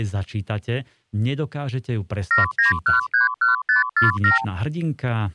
Multi-frequency trunk signalling (R2, with the far end's replies), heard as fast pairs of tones, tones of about 140 ms, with speech in Slovak. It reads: 79131547